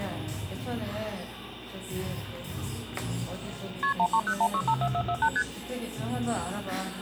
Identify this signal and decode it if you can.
Multi-frequency trunk signalling (R1, as on North American trunks), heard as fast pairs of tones, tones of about 70 ms, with the noise of a cafe. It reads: KP 1301654448 ST